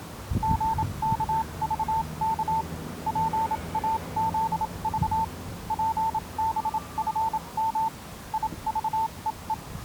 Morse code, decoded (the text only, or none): GKVK PAZV PBFM IVEE